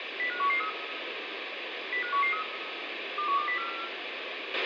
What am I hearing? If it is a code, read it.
Five-tone selective call (CCIR), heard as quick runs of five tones, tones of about 100 ms, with radio hiss, a squelch burst at the end and room echo. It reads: 05113 05113 21204